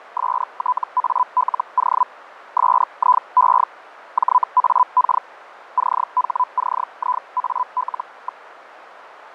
Hellschreiber (Feld-Hell, 122.5 baud), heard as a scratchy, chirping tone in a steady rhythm, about 1000 Hz, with radio static and fading. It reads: STALO SIE JAK CHCIAL.